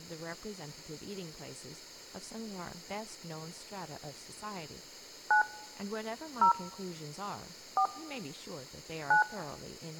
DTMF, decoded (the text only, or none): 9 0 4 9